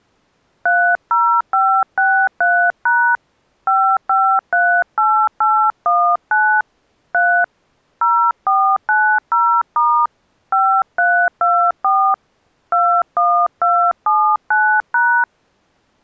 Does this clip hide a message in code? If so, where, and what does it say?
Yes: DTMF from 0.7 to 15.2 s, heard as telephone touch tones, dialled by hand, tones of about 300 ms. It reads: 30563# 5538819 3 0490* 5324 21279#